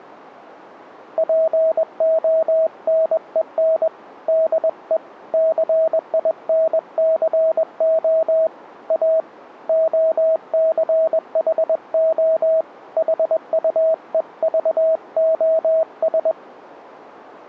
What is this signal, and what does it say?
Morse code, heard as a keyed tone, hand-sent with a paddle, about 21 wpm, 640 Hz. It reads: PONEN DE CINCO A OCHO HUEVOS